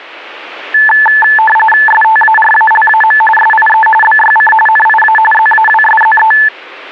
RTTY (45.45 baud, 850 Hz shift), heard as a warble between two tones, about 1310 Hz centre. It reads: STARALAM SIE BYC NIA ZAWSZE